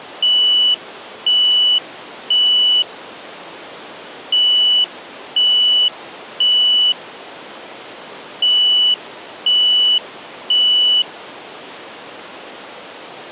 Alarm pattern, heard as an alarm's beeps, played three times, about 2950 Hz. Temporal three. Smoke or fire, evacuate.